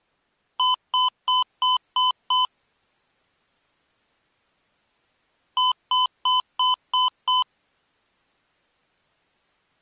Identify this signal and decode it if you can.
Beep code, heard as beeps from a small speaker, played twice, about 1010 Hz. 6 short. In AMI BIOS tables: keyboard controller gate A20 failure; in Dell tables: video card failure.